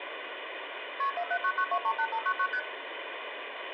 Multi-frequency trunk signalling (R1, as on North American trunks), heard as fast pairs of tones, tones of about 70 ms, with phone line noise and room echo. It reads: KP 4799238599 ST